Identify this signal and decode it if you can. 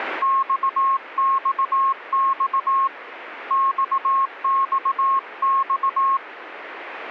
Morse code, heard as a keyed tone, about 18 wpm, 1080 Hz. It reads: XXX XXX